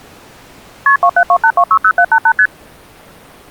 Multi-frequency trunk signalling (R1, as on North American trunks), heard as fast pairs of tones, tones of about 70 ms. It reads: KP 2728260788 ST